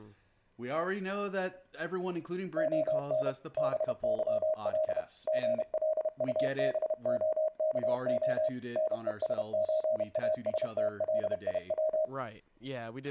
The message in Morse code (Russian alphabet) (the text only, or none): ОН БЫЛ ГЛУБОКО НЕСЧАСТЛИВ